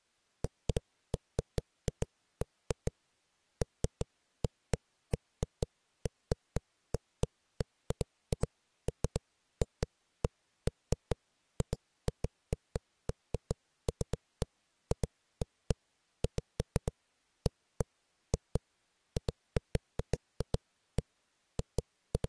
Irregular knocks on a wall. There is no code.